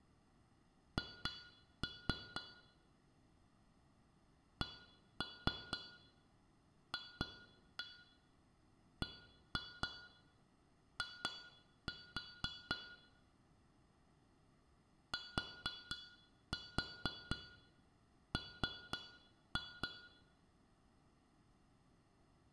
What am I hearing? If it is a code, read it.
Tap code, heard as taps on glass, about 4 knocks a second, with room echo. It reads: H CFBI TM